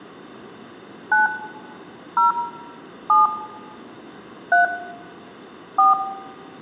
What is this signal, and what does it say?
DTMF, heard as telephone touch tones, dialled by hand, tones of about 150 ms, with room echo. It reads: 9 0 7 3 4